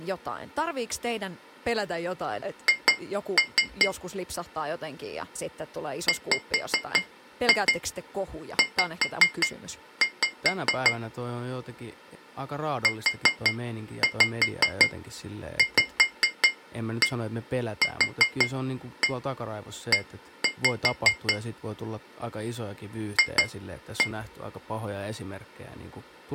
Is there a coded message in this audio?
Yes: tap code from 2.7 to 24.2 s, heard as taps on glass, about 5 knocks a second, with speech in Finnish. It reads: H WZ UVQE F